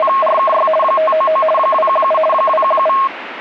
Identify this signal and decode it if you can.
RTTY (50 baud, 450 Hz shift), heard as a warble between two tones, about 860 Hz centre, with radio static. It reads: … 599 217 217